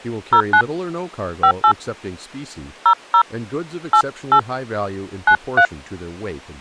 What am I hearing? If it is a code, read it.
DTMF, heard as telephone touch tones, dialled by hand, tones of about 80 ms, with speech in English. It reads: 09 58 00 88 93